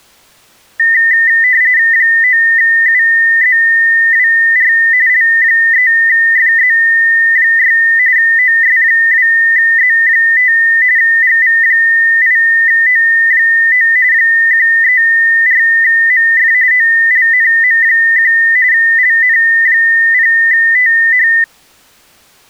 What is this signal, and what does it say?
RTTY (45.45 baud, 170 Hz shift), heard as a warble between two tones, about 1900 Hz centre. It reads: 9UZWR L3FZ6 OS2Z5 GV8O9 134MF OLNM1 LN0TH